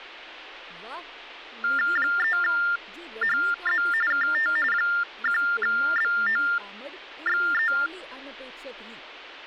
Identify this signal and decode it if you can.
TTY/TDD text telephone tones (45.45 baud Baudot), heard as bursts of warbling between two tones, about 400 Hz shift, 1600 Hz centre, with speech in Dogri. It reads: 3HZ KT 1BOXE